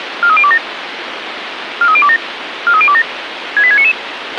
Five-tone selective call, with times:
0.2-0.6 43027
1.8-2.2 43027
2.7-3.0 43027
3.6-3.9 68699

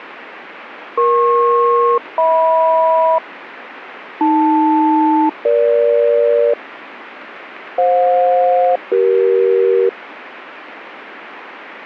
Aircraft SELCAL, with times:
1.0-3.2 EP-HM
4.2-6.5 AL-EG
7.8-9.9 FJ-CE

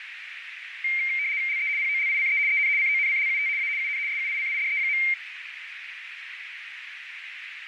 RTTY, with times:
1.5-1.7 LE
1.8-2.4 POLICE
2.5-2.7 EN
2.8-3.5 CONCLUT
3.6-3.7 A
3.8-4.0 UN
4.1-5.0 SUICIDE.

